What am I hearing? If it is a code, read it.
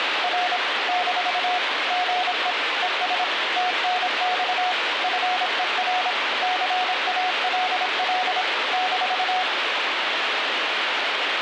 Morse code, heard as a keyed tone, machine-sent, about 26 wpm, 730 Hz, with radio static. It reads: R - GE ES TNX FER CALL -